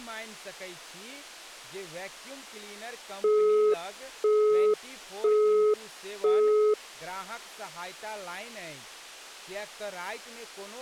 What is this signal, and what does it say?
Telephone call progress tone (single-tone plan, as in Europe, Japan and elsewhere), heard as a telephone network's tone, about 420 Hz, 0.5 s on and 0.5 s off, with speech in Maithili. Busy tone.